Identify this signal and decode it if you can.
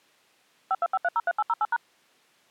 DTMF, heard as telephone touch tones, dialled by machine, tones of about 40 ms. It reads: 525303808#